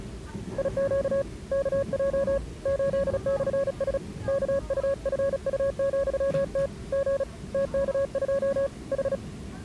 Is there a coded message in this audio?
Yes: Morse code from 0.5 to 9.2 s, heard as a keyed tone, hand-sent with a paddle, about 36 wpm, 550 Hz, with the noise inside a subway train. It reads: IQ KJ 8/S KUFU,T G TK2 H